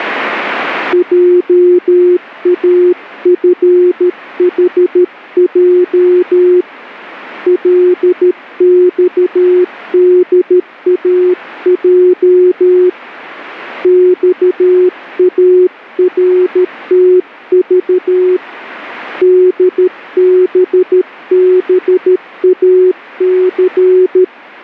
Morse code, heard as a keyed tone, hand-sent with a paddle, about 13 wpm, 360 Hz. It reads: JAFHJ LXDAJ XARTV DBBAC